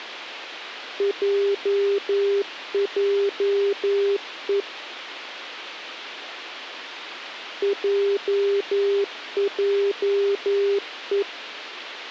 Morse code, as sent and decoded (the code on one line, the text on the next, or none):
.--- .--- . / .--- .--- .
JJE JJE